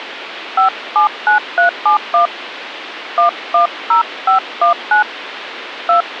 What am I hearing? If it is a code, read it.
DTMF, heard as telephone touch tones, dialled by hand, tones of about 120 ms, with phone line noise. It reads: 579371 110519 2